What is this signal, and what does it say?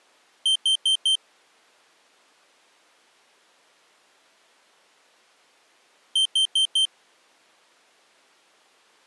Alarm pattern, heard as an alarm's beeps, played twice, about 3150 Hz. Temporal four. Carbon monoxide.